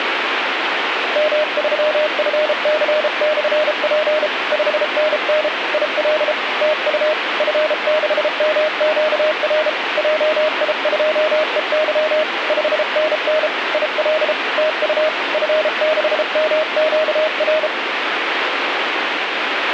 Morse code, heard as a keyed tone, hand-sent with a paddle, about 33 wpm, 620 Hz, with radio static. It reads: M3FC/P 5NN IL TU F6MQR JI2EY 5NN IL TU F6MQR